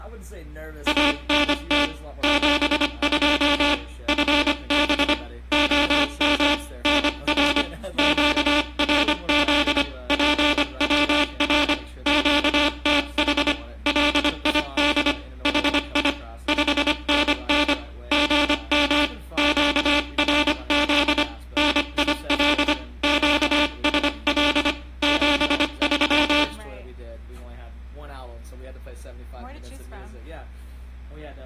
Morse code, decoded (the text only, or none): ANT 72 FB OM NR QRZ PWR QTH LID HI 5NN GM QRZ NIL QSL 73